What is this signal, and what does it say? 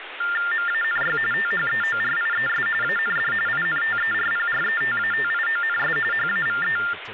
TTY/TDD text telephone tones (45.45 baud Baudot), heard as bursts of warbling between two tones, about 400 Hz shift, 1600 Hz centre, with phone line noise and speech in Tamil. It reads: MANY THEORIES AND INTERPRETATIONS HAVE